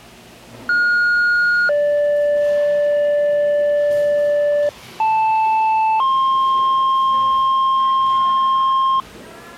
Two-tone page, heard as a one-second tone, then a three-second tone, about 1430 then 580 Hz, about 880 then 1060 Hz, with the noise of a cafe.